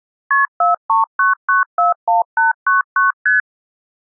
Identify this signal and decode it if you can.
Multi-frequency trunk signalling (R1, as on North American trunks), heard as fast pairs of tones, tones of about 140 ms. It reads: KP 439941899 ST